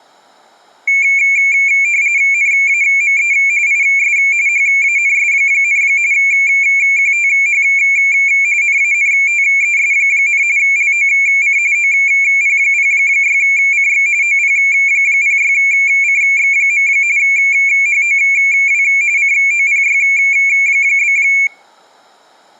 RTTY (45.45 baud, 170 Hz shift), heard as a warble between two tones, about 2300 Hz centre. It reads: NAME IS HANS, QTH NANTES, LOC OP06CX OP06CX. HOW COPY?